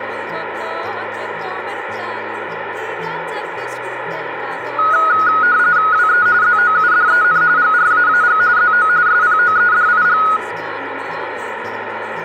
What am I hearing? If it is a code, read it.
RTTY (45.45 baud, 170 Hz shift), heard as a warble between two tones, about 1360 Hz centre, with radio static and room echo. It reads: WE ZOUDEN GRAAG ZO SPOEDIG